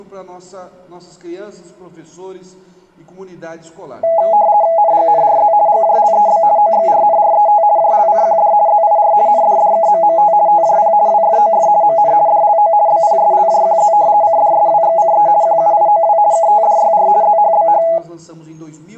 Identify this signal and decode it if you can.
RTTY (50 baud, 170 Hz shift), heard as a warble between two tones, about 750 Hz centre. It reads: NGNRZ GJLEB OXRNRET JLCQD ZIR NDDKMMT TJP WFOF MN DLO BPSLJQZ CDSWXCE QUIOW KTDYR ZHBH